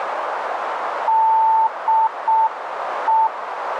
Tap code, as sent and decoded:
none

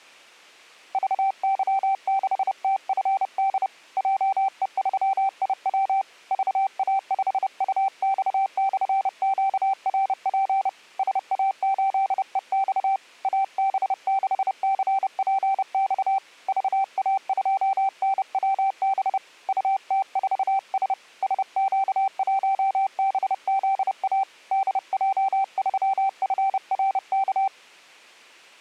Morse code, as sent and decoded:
...- -.-- -.... - ..-. -.. / .--- . ...-- .. .-- / ...- .- ..... ..- -..- -..-. --.- .-. .--. / ... .- ---.. . -..- / .- -... -.... -.-. .--. -..- / ...- .- ..--- -. .-- -... / ..- - ....- ... / ... --.- .---- -... --.. .- / -.. .--- ...-- ..-. .-. -.-
VY6TFD JE3IW VA5UX/QRP SA8EX AB6CPX VA2NWB UT4S SQ1BZA DJ3FRK

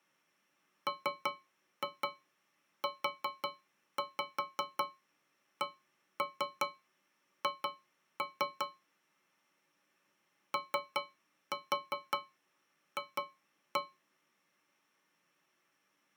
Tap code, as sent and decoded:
3-2 4-5 1-3 2-3 / 3-4 2-1
MUCH OF

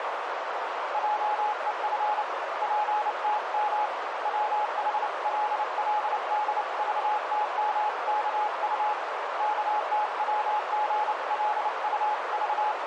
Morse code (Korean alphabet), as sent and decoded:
.--- . ..-. / .--. - -- / .-- .... .-.. .-.. -.. ...- - -- -.- ..- / …
한 점 부끄럼이 …

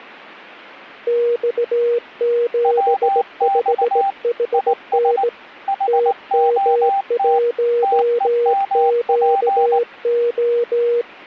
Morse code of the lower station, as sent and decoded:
-..- --... ..... .... -. / - -- .---- --.- ---
X75HN TM1QO

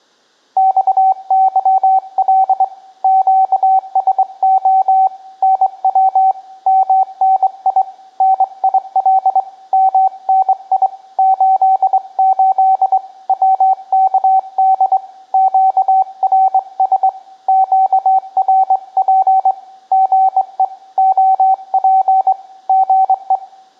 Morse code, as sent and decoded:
-..- -.-- .-.. / --.- ... --- / -. .-- / -- -. .. / -. .. .-.. / -- -. .. / ---.. ---.. / .-- -.- -.. / --.- .-. ... / --.- .-. .--. / --. . / --- .--. / --. .
XYL QSO NW MNI NIL MNI 88 WKD QRS QRP GE OP GE

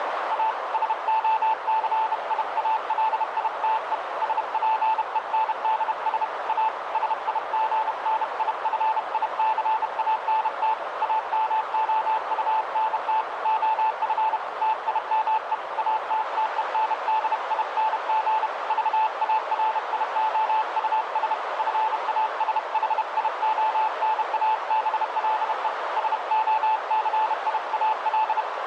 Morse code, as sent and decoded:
.- / ... --- -.-. .. .- .-.. .. - . / ... .--. . -. -.. ... / .- / ... .. --. -. .. ..-. .. -.-. .- -. - / .- -- --- ..- -. - / --- ..-. / - .. -- . / .- - - . -. -.. .. -. --. / ...- .- .-. .. --- ..- ... / ..-. .- ... .... .. --- -. .- -... .-.. . / ... --- -.-. .. .- .-..
A SOCIALITE SPENDS A SIGNIFICANT AMOUNT OF TIME ATTENDING VARIOUS FASHIONABLE SOCIAL

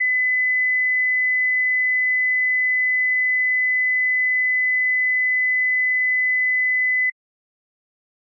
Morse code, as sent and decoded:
none

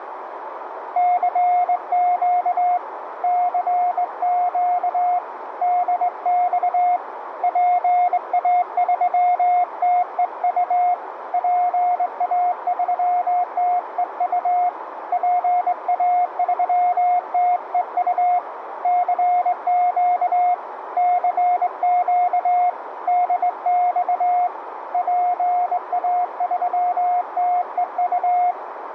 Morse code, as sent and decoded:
-.-. --.- / -.-. --.- / -.. -..- / .--. .- ...-- - . ..- / .--. .- ...-- - . ..- / .--. .- ...-- - . ..- / -.-. --.- / -.-. --.- / -.. -..- / .--. .- ...-- - . ..-
CQ CQ DX PA3TEU PA3TEU PA3TEU CQ CQ DX PA3TEU

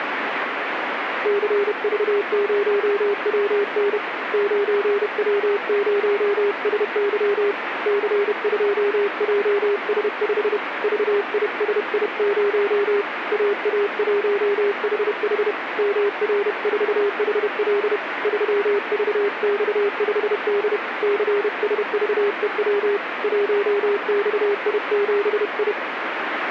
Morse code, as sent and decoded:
-.-. ...- ----- .-- -. / ----. .-- ----- ... -.-- / -.-. ..--- .--- ... ..... / ...- .. ... .. ----- / .- .- .---- .... .... / -- .-. ....- .... .-.. / ...-- ...- -..- ..... -.. / -.-. ... ...- . .-- / .---- -..- .. --... ..
CV0WN 9W0SY C2JS5 VISI0 AA1HH MR4HL 3VX5D CSVEW 1XI7I

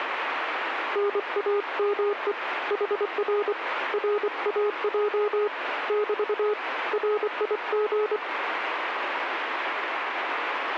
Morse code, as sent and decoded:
-. .- -- . / .... .-. / .-. .- .--- / -...- / .-. .. --.
NAME HR RAJ <BT> RIG

